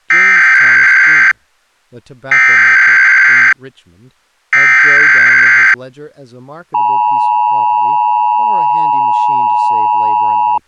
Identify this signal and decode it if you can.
Emergency Alert System (SAME) tones (header bursts, then the 853 and 960 Hz attention tone), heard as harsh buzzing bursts, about 520.83 baud, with speech in English.